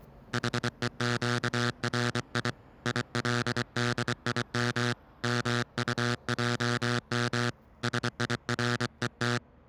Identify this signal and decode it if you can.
Morse code (Hebrew alphabet), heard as a buzzer, hand-sent with a paddle, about 24 wpm, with street noise. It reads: חוקרי ילדים מטעם שירות